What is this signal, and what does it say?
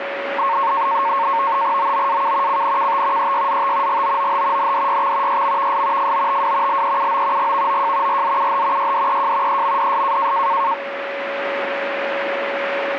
NAVTEX (SITOR-B), 100 baud, 170 Hz shift, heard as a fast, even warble, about 1000 Hz centre, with radio static and a steady whistle near 560 Hz. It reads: OOAK CNKT EYZT GOOH NDYX YMVS FOTW LEUO GVOJ RZUH YDEJ EMDS